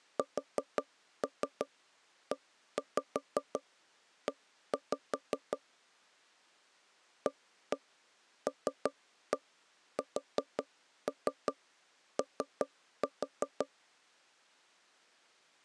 Tap code, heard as knocks on wood, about 5 knocks a second. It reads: SEE ALSO